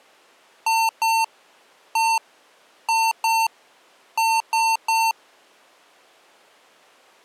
Beep code, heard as beeps from a small speaker, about 900 Hz. 2-1-2-3. In Phoenix BIOS tables: ROM copyright notice check failure.